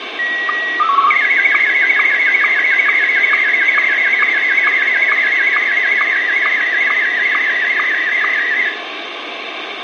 SSTV (slow-scan television), Martin M1, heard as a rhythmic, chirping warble, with radio hiss and room echo.